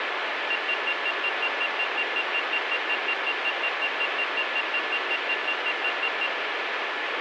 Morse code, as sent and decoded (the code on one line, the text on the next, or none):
none